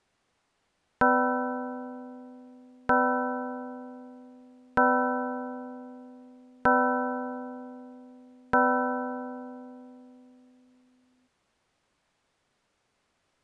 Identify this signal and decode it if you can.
Clock strike, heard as a bell. 5. Five o'clock.